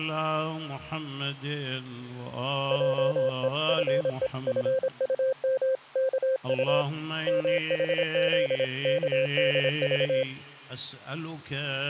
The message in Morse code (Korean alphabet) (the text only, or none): 하나님이 뭍을